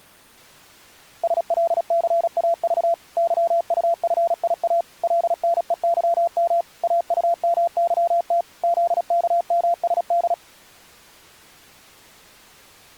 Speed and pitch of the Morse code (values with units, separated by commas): 36 wpm, 680 Hz